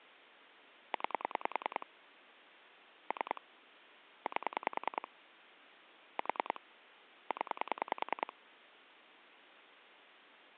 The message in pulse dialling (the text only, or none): 9 3 8 4 0